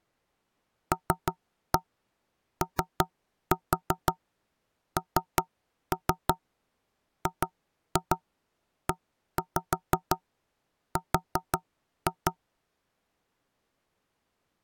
Tap code, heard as knocks on wood, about 5 knocks a second. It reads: LONGER